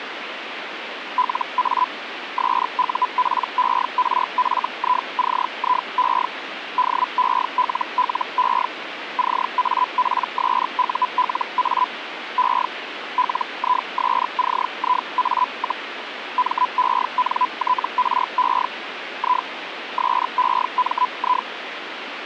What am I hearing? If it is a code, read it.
Hellschreiber (Feld-Hell, 122.5 baud), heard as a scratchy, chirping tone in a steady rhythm, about 1000 Hz, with radio static. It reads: LA SUPERFICIE DELLE CAPSULA E LISCIA, MENTRE I SEMI